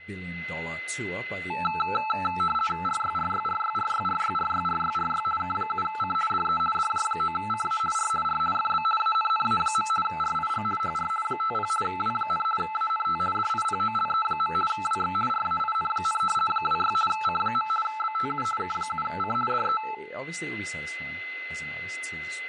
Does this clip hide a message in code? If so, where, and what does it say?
Yes: RTTY (50 baud, 450 Hz shift) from 1.5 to 19.9 s, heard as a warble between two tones, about 1100 Hz centre, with a steady whistle near 2040 Hz, room echo and speech in English. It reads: RYRYRYRYRYRYRYRY K7C DE DJ9CA R R FB ANNA. RIG HR 50 W, ANT DIPOLE. WX RAIN, 26 C. BTU K7C DE